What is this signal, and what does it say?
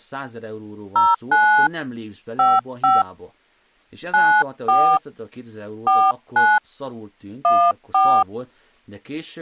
DTMF, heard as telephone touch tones, dialled by hand, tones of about 250 ms, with speech in Hungarian. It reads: 09 55 94 49 14